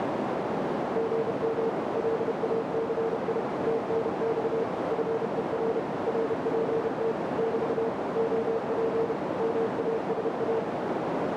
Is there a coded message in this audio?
Yes: Morse code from 0.9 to 10.7 s, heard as a keyed tone, machine-sent, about 31 wpm, 450 Hz, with heavy radio static and a narrow filter. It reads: GM LACI TNX FER RPT <BT> OP MASA